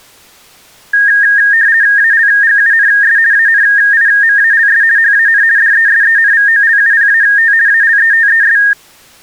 RTTY (50 baud, 170 Hz shift), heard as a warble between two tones, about 1750 Hz centre. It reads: ALGUNS ANIMALS HAN DESENVOLUPAT ALETES